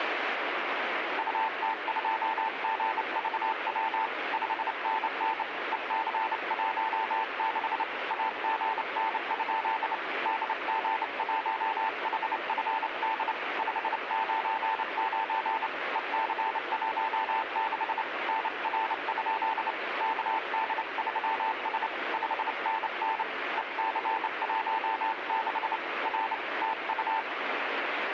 Morse code, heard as a keyed tone, hand-sent with a straight key, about 28 wpm, 890 Hz, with radio static. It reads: UT2GVW 5NN EC16 AGN? DG1HFD 599 EC16 NR? KD3S 5NN EC16 R TU